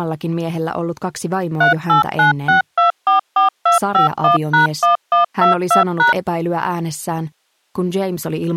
DTMF, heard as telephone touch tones, dialled by machine, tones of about 130 ms. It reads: 3896244251#1122#